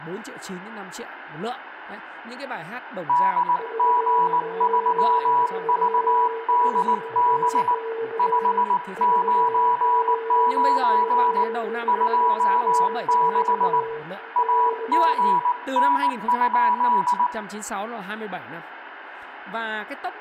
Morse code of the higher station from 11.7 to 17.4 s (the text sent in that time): 26 AGN?